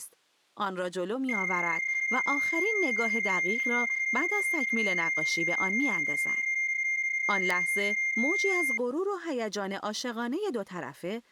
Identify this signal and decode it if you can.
PSK31 (31.25 baud), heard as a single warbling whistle, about 2100 Hz, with speech in Persian.